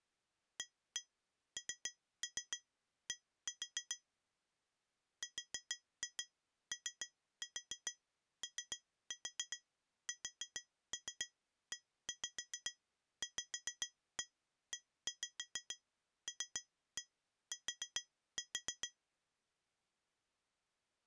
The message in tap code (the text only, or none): AND ROOSEVELT